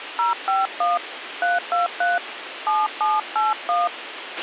DTMF, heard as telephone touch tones, dialled by hand, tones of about 170 ms, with radio hiss and a squelch burst at the end. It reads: 051 323 7781